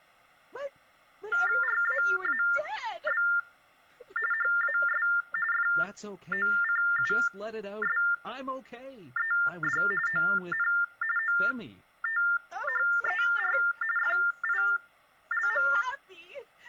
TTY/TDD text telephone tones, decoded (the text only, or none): RAAB HAS FOCUSED ON OTHER FILM